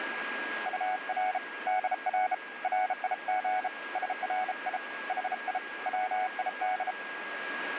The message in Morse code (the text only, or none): UR DR RIG SRI HI WID